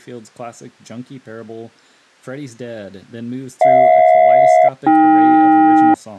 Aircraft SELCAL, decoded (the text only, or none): HJ-AK